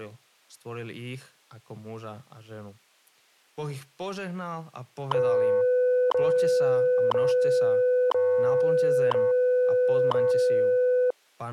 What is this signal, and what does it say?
Radio time signal (WWV, Colorado), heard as ticks, one a second, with speech in Slovak.